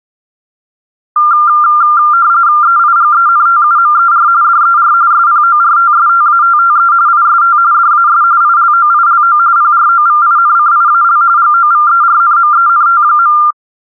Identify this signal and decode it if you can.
RTTY (45.45 baud, 170 Hz shift), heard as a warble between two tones, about 1290 Hz centre. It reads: EIGENTUMER DER SPORTSTATTE IST DAS ILOILO PROVINCIAL GOVERNMENT.